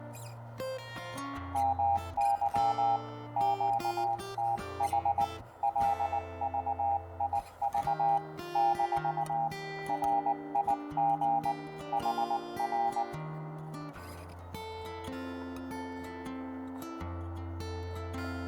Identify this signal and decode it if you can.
Morse code, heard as a keyed tone, hand-sent with a paddle, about 19 wpm, 800 Hz, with radio static and room echo. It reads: MY QTH LVIV - RIG HR